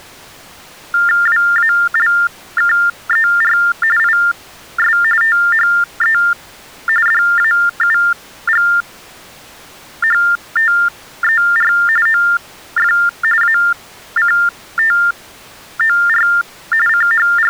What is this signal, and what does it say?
TTY/TDD text telephone tones (45.45 baud Baudot), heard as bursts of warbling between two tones, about 400 Hz shift, 1600 Hz centre. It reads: WALKER IS THE DAUGHTER OF ACTOR …